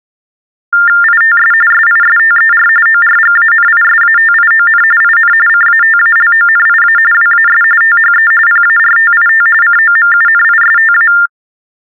TTY/TDD text telephone tones (45.45 baud Baudot), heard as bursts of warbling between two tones, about 400 Hz shift, 1600 Hz centre. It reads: ITS SISTER ORGANISATION IN CATALONIA WAS THE PARTIT COMUNISTA